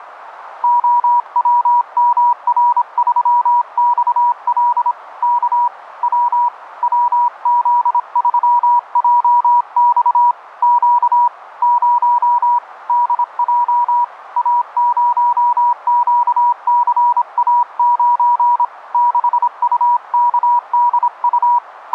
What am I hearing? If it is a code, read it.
Morse code, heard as a keyed tone, hand-sent with a paddle, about 26 wpm, 960 Hz, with radio static. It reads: OWMR3XL K W WZ3JX Q 0 DJ A0QCA9 6UKDU …